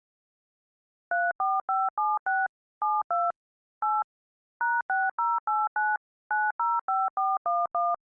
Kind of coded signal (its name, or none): DTMF